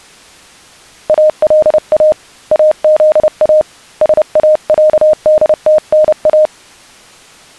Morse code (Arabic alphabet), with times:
1.1-2.1 الا
2.5-3.6 اذا
4.0-6.5 ساعدتنا

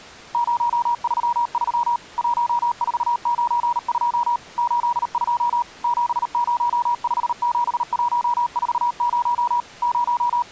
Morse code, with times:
0.3-2.0 033
2.2-4.4 1492
4.6-5.6 82
5.8-9.6 7057140
9.8-10.5 …

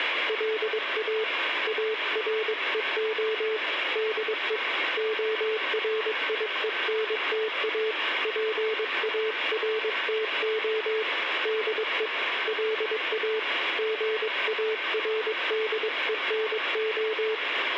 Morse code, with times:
0.3-1.2 LA
1.7-3.6 AREO
4.0-4.6 DE
5.0-7.9 ORIENTA
8.2-11.0 PARTO
11.5-12.1 DE
12.5-13.4 LA
13.8-17.3 GARDENO

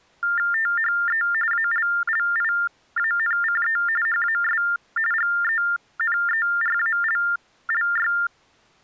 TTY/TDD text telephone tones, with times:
0.5-1.2 THE
1.5-3.8 ALLIANCE
4.1-4.6 HAS
5.1-8.1 GENERALLY

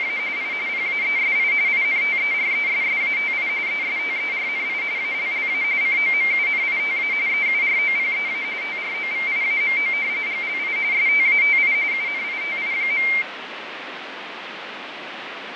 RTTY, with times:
0.0-0.2 …
0.4-0.5 I
0.7-1.5 PAESI
1.7-3.5 INTERESSATI
3.7-4.8 ESTERNI
5.0-5.6 ALLA
5.8-7.1 COMUNITA
7.3-8.4 EUROPEA
8.6-9.9 TROVIAMO
10.3-10.8 GLI
10.9-11.7 STATI
11.9-13.1 UNITI.

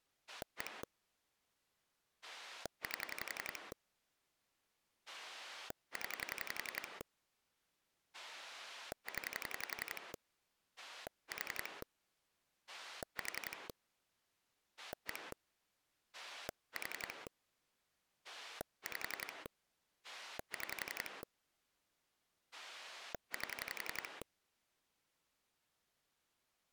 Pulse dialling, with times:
0.3-0.8 1
2.2-3.7 8
5.1-7.0 0
8.1-10.1 0
10.8-11.8 4
12.7-13.7 4
14.8-15.3 1
16.1-17.3 4
18.2-19.5 5
20.0-21.2 6
22.5-24.2 8

